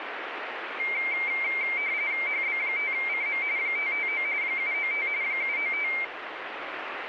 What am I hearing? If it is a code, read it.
RTTY (45.45 baud, 170 Hz shift), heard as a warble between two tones, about 2200 Hz centre, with radio static. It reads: HB5CM 559 795 795